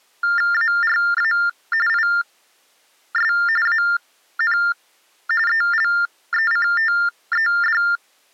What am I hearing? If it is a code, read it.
TTY/TDD text telephone tones (45.45 baud Baudot), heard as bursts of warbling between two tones, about 400 Hz shift, 1600 Hz centre. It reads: ARA IS AN ELECTED